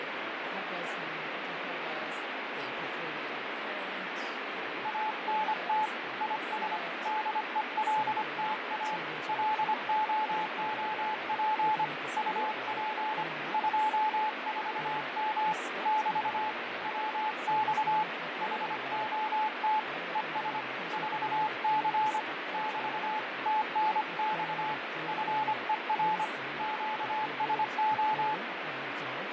Morse code, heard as a keyed tone, hand-sent with a paddle, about 25 wpm, 860 Hz, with radio static and speech in English. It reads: ANT IS DELTA LOOP UP 24M <BT> WX HOT ES 4C <BT> TNX FER QSO